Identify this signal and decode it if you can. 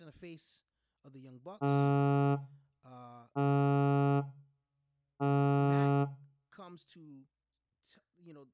Ship horn signal, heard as a ship's horn, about 140 Hz, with room echo and speech in English. 3 short. At sea: I am operating astern propulsion.